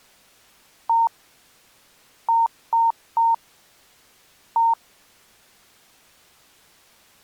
Beep code, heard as beeps, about 920 Hz. 1-3-1. In Phoenix BIOS tables: memory refresh failure.